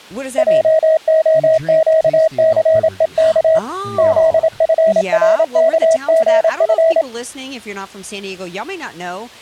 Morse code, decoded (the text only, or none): JOQCEK ZFRKGF